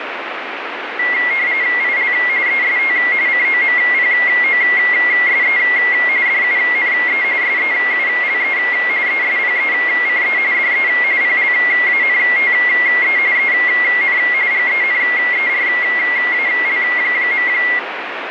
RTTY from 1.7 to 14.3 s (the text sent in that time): IL EST COMPOSE DUNE SEULE ESPECE DE PLANTE EN